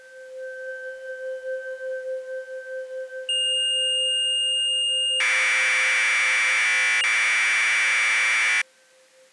Commodore tape loading (standard loader), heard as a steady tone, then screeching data.